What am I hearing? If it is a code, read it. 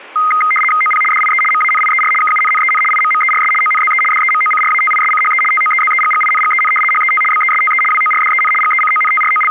RTTY (75 baud, 850 Hz shift), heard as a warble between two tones, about 1700 Hz centre. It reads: OP DIE MANIER KUNNEN IMMERS ONZE DEMOCRATISCHE TOEZEGGINGEN HET BESTE WORDEN …